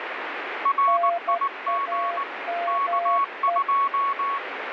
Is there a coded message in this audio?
Yes: Morse code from 0.6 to 4.4 s, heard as two keyed tones, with radio static. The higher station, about 19 wpm, 1110 Hz: RIG K2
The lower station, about 12 wpm, 690 Hz: NAME